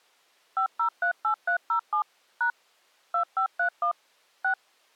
DTMF, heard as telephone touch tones, dialled by machine, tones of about 100 ms. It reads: 5038307 # 2531 6